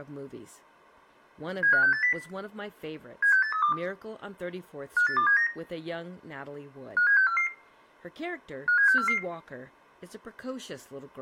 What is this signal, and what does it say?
Five-tone selective call (CCIR), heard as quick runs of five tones, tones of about 100 ms, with room echo and speech in English. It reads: 75680 76832 58279 57644 57644